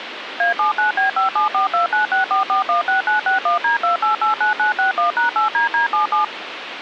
DTMF, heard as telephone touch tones, dialled by machine, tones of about 120 ms, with phone line noise. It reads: A79B5742964416961D2889961#8DD77